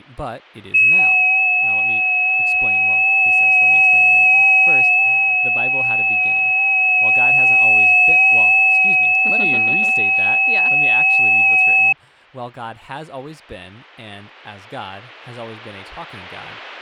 FT8 (several signals at once), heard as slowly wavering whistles, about 6.25 baud, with speech in English.